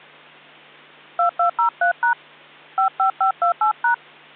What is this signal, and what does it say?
DTMF, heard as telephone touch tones, dialled by hand, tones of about 100 ms. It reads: 2203# 55528#